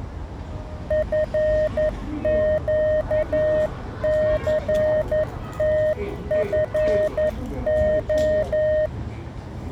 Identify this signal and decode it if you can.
Morse code, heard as a keyed tone, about 11 wpm, 620 Hz, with the noise of a residential street. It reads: FQCTFO